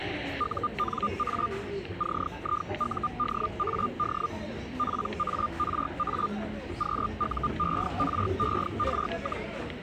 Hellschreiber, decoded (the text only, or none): UNA CIUDAD PARA QUERER,